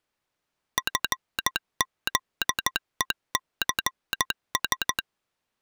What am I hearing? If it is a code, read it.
Morse code, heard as a telegraph sounder, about 14 wpm. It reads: FZECS